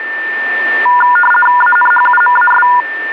RTTY (50 baud, 450 Hz shift), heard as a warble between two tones, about 1210 Hz centre, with a steady whistle near 1790 Hz. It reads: ANHUMAS